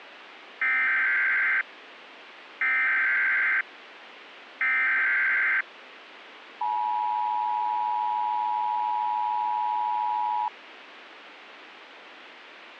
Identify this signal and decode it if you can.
Emergency Alert System (SAME) tones (header bursts, then the 853 and 960 Hz attention tone), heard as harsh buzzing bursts, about 520.83 baud, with radio hiss.